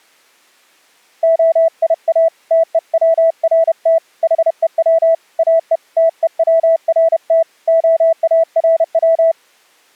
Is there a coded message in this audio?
Yes: Morse code (Hebrew alphabet) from 1.2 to 9.4 s, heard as a keyed tone, hand-sent with a paddle, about 31 wpm, 660 Hz. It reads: היא תוצרת חוץ או תוצרת הארץ